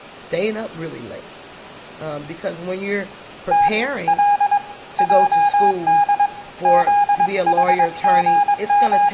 Morse code, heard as a keyed tone, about 22 wpm, 820 Hz, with room echo and speech in English. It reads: T L JD …